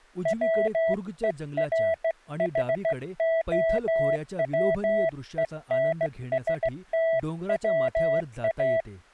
Morse code (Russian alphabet), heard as a keyed tone, hand-sent with a straight key, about 16 wpm, 660 Hz, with speech in Marathi. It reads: ВЕРХОВЕНСТВА